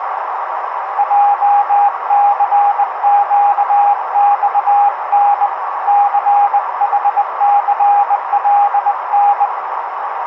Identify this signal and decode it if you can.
Morse code, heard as a keyed tone, hand-sent with a bug key, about 20 wpm, 810 Hz, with radio static and a narrow filter. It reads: JCQXN CHCLN